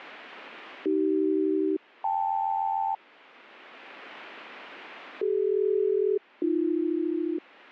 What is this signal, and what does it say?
Aircraft SELCAL, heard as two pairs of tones. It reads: AC-KL CD-AB